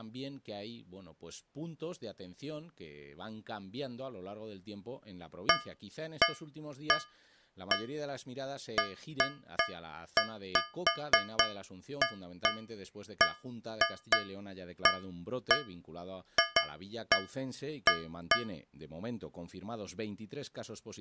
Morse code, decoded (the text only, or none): none